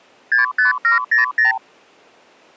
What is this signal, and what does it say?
Multi-frequency trunk signalling (R2, with the far end's replies), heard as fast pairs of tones, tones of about 130 ms. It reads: 65700